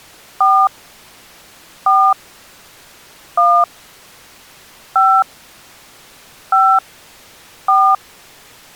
DTMF, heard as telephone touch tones, dialled by hand, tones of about 270 ms. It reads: 4 4 1 5 5 4